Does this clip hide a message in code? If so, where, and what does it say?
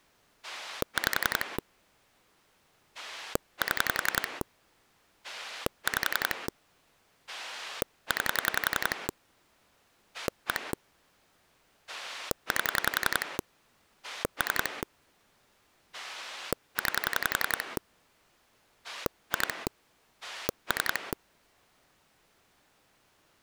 Yes: pulse dialling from 0.4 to 21.1 s, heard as a rotary dial, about 11 pulses a second. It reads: 5 7 5 9 1 8 3 9 2 3